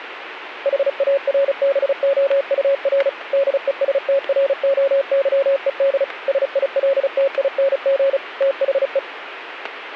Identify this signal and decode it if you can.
Morse code, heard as a keyed tone, machine-sent, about 35 wpm, 550 Hz, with radio static. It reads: HARBOUR DESTROYED SILTING THE